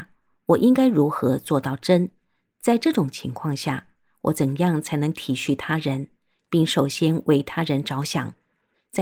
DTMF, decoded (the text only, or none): none